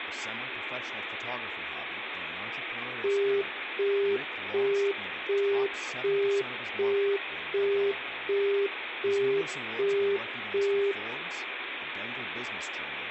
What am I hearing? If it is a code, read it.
Telephone call progress tone (as in the UK, Australia and similar networks), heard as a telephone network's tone, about 400 Hz, 0.375 s on and 0.375 s off, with phone line noise, room echo and speech in English. Busy tone.